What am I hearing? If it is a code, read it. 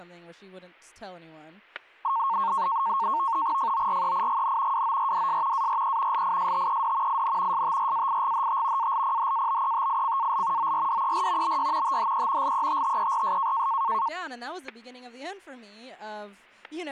NAVTEX (SITOR-B), 100 baud, 170 Hz shift, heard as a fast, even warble, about 1000 Hz centre, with static crashes and speech in English. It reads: FOREIGN WORDS ARE LISTED IN STRAIGHT ALPHABETICAL ORDER BY THE LETTERS